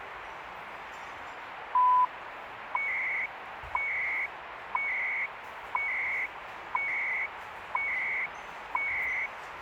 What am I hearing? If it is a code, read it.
Radio time signal (CHU, Canada), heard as beeps and data bursts, one a second, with radio static and the noise of a crowd indoors.